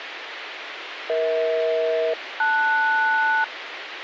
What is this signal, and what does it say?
Aircraft SELCAL, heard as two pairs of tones, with radio hiss. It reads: EH-LS